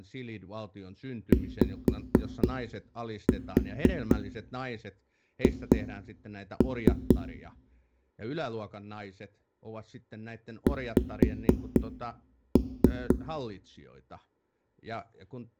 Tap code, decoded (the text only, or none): YH X